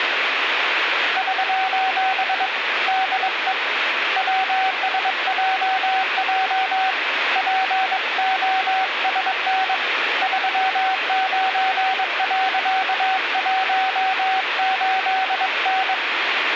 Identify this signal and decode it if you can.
Morse code, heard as a keyed tone, hand-sent with a bug key, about 22 wpm, 760 Hz, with radio static. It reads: <SOS> DE WSJJ POSN 39.18N